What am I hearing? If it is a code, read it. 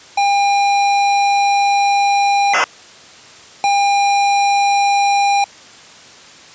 ZX Spectrum tape loading, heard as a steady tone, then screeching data.